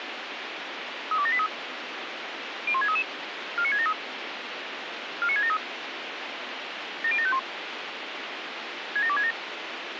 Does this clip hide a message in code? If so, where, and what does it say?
Yes: five-tone selective call (ZVEI) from 1.1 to 9.3 s, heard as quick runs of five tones, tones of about 70 ms, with radio hiss and a squelch burst at the end. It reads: 32783 01633 49673 49673 70751 67267